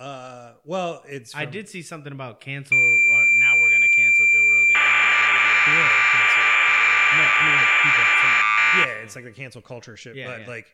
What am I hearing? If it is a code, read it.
Cassette data (Kansas City type), 1200 baud, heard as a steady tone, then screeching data, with speech in English.